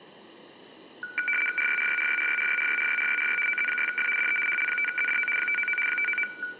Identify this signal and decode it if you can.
RTTY (75 baud, 850 Hz shift), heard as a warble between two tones, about 1900 Hz centre, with room echo. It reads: RYRYRYRYRYRYRYRYRY OZ6F DE HL5ZDO 599 599